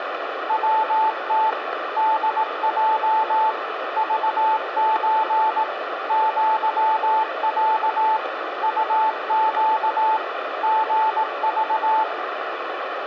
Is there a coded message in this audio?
Yes: Morse code (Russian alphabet) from 0.4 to 12.1 s, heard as a keyed tone, machine-sent, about 18 wpm, 880 Hz, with radio static and room echo. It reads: ВТ ДЙ ЖЧ ЪЯ УЩ ГЖ